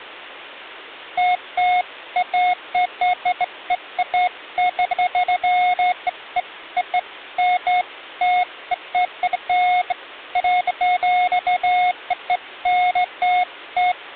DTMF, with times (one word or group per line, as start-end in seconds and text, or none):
none